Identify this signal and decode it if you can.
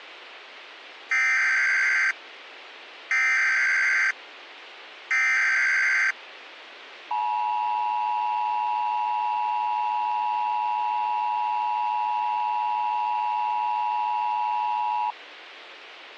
Emergency Alert System (SAME) tones (header bursts, then the 853 and 960 Hz attention tone), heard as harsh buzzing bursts, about 520.83 baud, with radio hiss.